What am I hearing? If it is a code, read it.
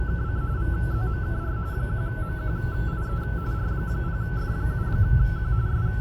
RTTY (45.45 baud, 170 Hz shift), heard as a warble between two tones, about 1420 Hz centre, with radio static, a steady whistle near 840 Hz and the noise inside a car. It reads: … VZMKR 1MQIE R0F7Q …